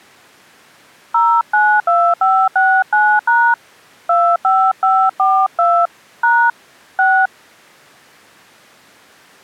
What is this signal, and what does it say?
DTMF, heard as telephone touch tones, dialled by hand, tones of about 270 ms. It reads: 092569# 25542 # 6